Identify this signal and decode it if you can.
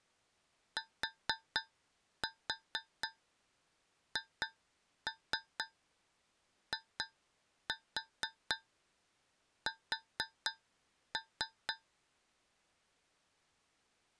Tap code, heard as taps on a metal pipe, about 4 knocks a second. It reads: THIS